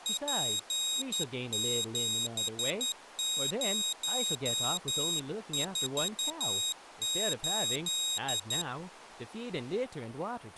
Morse code, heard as a high beeper, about 11 wpm, 3800 Hz, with speech in English. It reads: P7048